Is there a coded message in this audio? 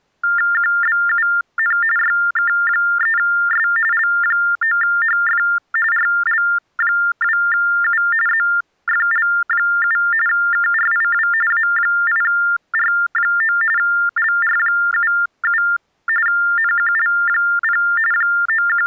Yes: TTY/TDD text telephone tones (45.45 baud Baudot) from 0.2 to 18.9 s, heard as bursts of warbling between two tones, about 400 Hz shift, 1600 Hz centre. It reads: QBUN YK3S L9HF RL2U ZFL7 KRIW A8R9 LR77 NQL0 …